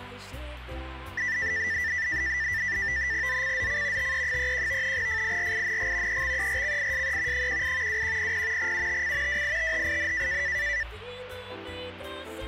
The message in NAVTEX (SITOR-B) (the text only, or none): ZCZC TE31 FIRING EXERCISE 18 2100 UTC WITHIN